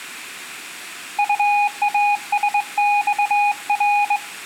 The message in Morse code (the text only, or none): UASXR